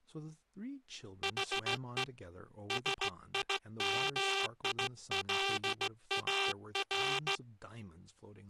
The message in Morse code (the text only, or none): HE SIMILAR